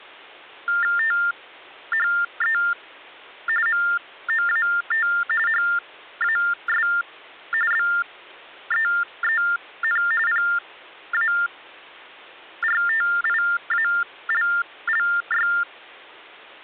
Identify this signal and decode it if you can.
TTY/TDD text telephone tones (45.45 baud Baudot), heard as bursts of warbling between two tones, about 400 Hz shift, 1600 Hz centre, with hum. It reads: THE MOAT HAS BEEN PARTIALLY